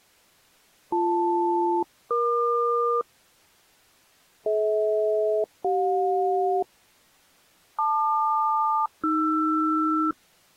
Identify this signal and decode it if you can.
Aircraft SELCAL, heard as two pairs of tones. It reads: BL-EQ DH-CJ LQ-AR